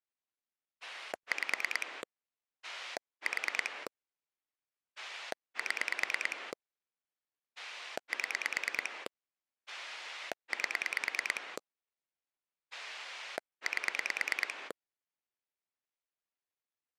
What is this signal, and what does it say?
Pulse dialling, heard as a rotary dial, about 9 pulses a second. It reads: 5 4 7 7 8 8